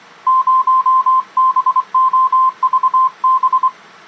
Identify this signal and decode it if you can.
Morse code, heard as a keyed tone, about 24 wpm, 1040 Hz. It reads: 0BOVB